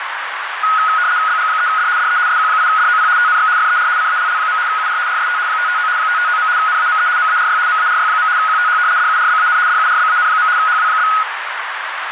RTTY (75 baud, 170 Hz shift), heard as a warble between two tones, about 1360 Hz centre, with radio static and a narrow filter. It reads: BG3D DE SQ8DOP TNX FER CALL. UR RST 559 559. NAME MARY MARY. QTH DURBAN DURBAN. HW?